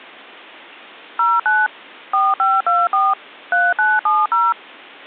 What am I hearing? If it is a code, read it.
DTMF, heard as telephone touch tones, dialled by machine, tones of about 210 ms. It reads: 09 4524 3970